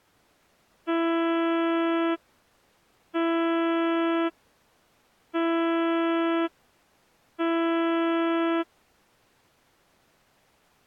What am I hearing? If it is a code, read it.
Ship horn signal, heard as a ship's horn, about 330 Hz. 4 short. At sea: a pilot vessel's identity signal in fog.